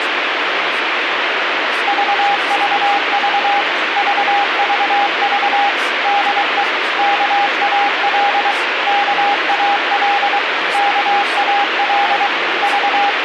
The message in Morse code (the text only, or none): VVV VVV DE KAL KAL KAL …